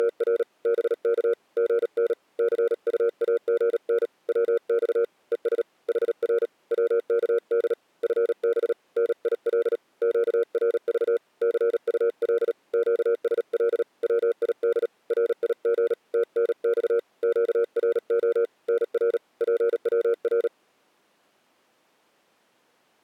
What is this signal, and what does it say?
Morse code, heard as a keyed tone, hand-sent with a paddle, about 37 wpm, 470 Hz. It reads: … BK GN CUAGN WX ES HR WKD FB NIL QRV CUL QSL WID RIG TNX QRO NR PWR